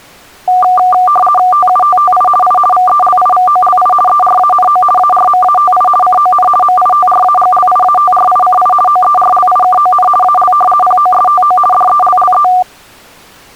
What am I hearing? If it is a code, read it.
RTTY (50 baud, 450 Hz shift), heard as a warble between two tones, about 960 Hz centre. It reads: TUTTI I VELIVOLI ERANO ARMATI CON MITRAGLIATRICI OERLIKON AL POSTO DELLE